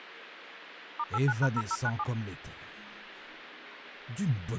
DTMF, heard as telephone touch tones, dialled by machine, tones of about 50 ms, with phone line noise. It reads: *89#0097